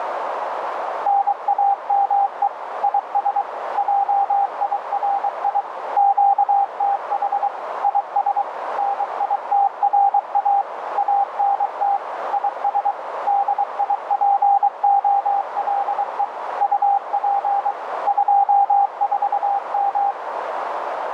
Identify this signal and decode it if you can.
Morse code, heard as a keyed tone, machine-sent, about 23 wpm, 800 Hz, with radio static and a narrow filter. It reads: NAME IS JIRI QTH IS NITRA ANT IS DIPOLE UP 24M